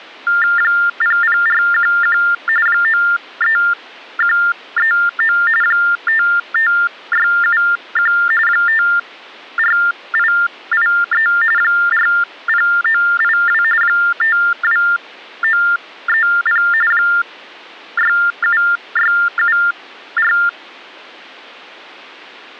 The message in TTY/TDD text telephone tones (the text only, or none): 00411 93139 55671 54883 40982 52930 67674